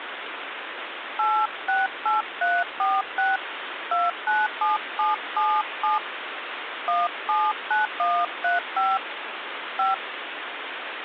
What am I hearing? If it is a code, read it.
DTMF, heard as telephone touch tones, dialled by hand, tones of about 210 ms, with phone line noise. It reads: 868346 297777 179135 5